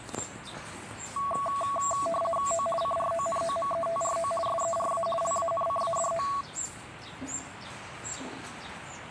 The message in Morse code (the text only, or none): none